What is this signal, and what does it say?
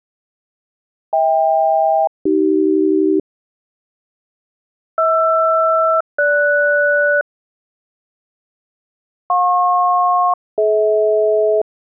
Aircraft SELCAL, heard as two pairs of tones. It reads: HK-AC HR-GS JP-DH